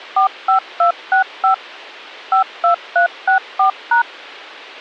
DTMF, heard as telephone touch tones, dialled by machine, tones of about 110 ms. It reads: 45265 52364#